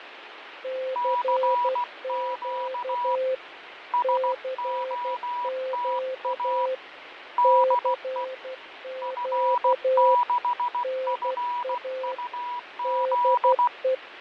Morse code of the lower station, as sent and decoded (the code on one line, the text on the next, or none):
-.-. --.- / -.-. --.- / -.-. --.- / -. .- / -.. .
CQ CQ CQ NA DE